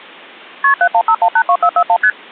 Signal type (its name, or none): multi-frequency trunk signalling